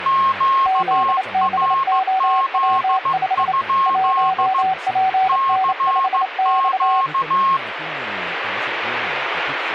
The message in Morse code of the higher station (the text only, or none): QRZ? CQ